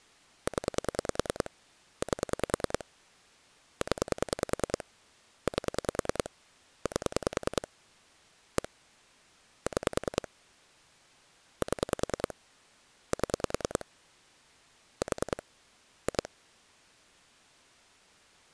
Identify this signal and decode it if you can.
Pulse dialling, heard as clicks on a phone line, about 10 pulses a second. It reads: 0 8 0 8 8 1 6 7 7 4 2